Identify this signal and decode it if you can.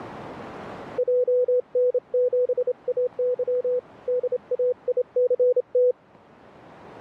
Morse code, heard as a keyed tone, hand-sent with a straight key, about 28 wpm, 500 Hz. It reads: JN7AY DAICT